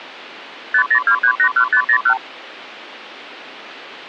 Multi-frequency trunk signalling (R2, with the far end's replies), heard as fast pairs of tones, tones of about 80 ms. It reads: 502381501